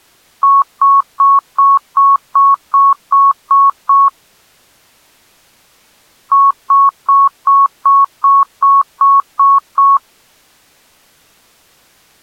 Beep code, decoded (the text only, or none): 10 short